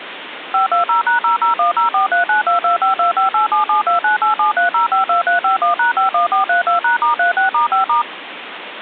DTMF, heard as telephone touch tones, dialled by machine, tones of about 120 ms, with phone line noise. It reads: 520#00104392252587729873052351#51432#*36*5*